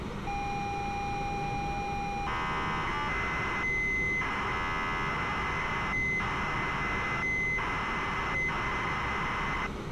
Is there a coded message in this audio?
Yes: ZX Spectrum tape loading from 0.3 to 9.7 s, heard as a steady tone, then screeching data, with street noise.